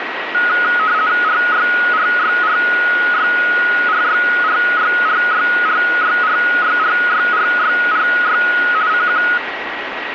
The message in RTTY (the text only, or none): RYRYRYRYRYRYRYRYRYRYRY CQ